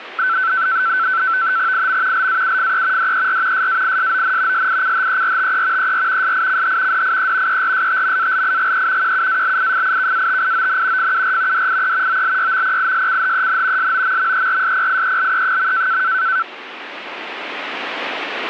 NAVTEX (SITOR-B), 100 baud, 170 Hz shift, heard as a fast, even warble, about 1430 Hz centre. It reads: IM LAUFE DER SAISON SICHERTE ER SICH DIE ERSTMALIGE QUALIFIKATION FUR DIE OLYMPISCHEN SOMMERSPIELE.